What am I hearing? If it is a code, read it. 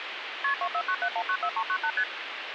Multi-frequency trunk signalling (R1, as on North American trunks), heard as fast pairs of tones, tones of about 70 ms, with phone line noise. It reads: KP 2497194398 ST